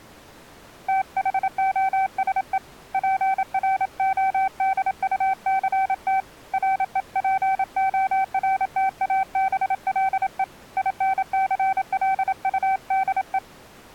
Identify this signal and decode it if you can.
Morse code, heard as a keyed tone, hand-sent with a paddle, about 27 wpm, 770 Hz. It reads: THOSE PRODUCT REPORTABLE INCLUDE